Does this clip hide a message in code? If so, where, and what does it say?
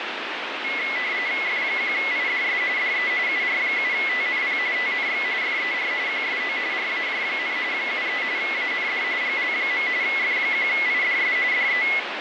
Yes: RTTY (45.45 baud, 170 Hz shift) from 0.6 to 12.0 s, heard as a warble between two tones, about 2100 Hz centre, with radio static. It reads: F1IDS DE UR7TNP TNX FER QSO RAJ, 73 AND GL. F1IDS DE